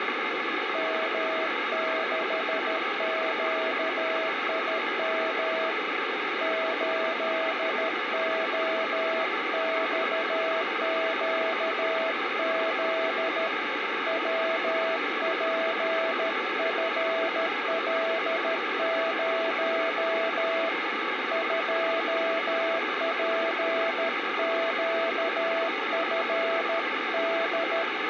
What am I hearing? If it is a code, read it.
Morse code, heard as a keyed tone, hand-sent with a paddle, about 13 wpm, 650 Hz, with radio static. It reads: M6QIM 8OXQZ WPFL0 2PQFD